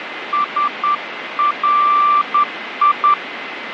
Morse code, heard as a keyed tone, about 10 wpm, 1180 Hz, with radio static and a steady whistle near 2050 Hz. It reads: SRI